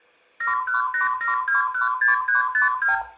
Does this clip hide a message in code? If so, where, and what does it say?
Yes: multi-frequency trunk signalling (R2, with the far end's replies) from 0.4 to 3.0 s, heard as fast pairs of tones, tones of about 130 ms, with room echo. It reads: 7187216352